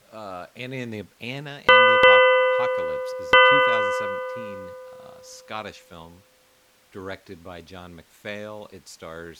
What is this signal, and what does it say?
Ship's bell, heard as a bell, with speech in English. 3. Three half-hours of the watch have passed.